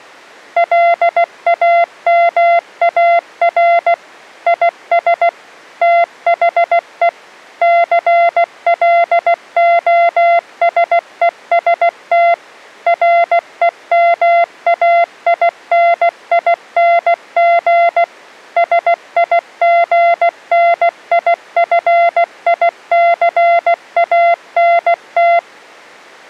Morse code, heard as a keyed tone, machine-sent, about 16 wpm, 690 Hz. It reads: LAMAR IS THE CLOSEST REMAINING SIGNIFICANT